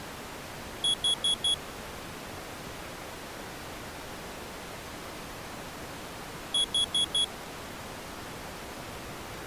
Alarm pattern, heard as an alarm's beeps, played twice, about 3350 Hz. Temporal four. Carbon monoxide.